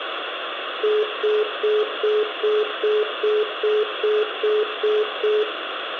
Telephone call progress tone (single-tone plan, as in most of Europe), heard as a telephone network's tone, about 420 Hz, 0.2 s on and 0.2 s off, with phone line noise and room echo. Congestion tone.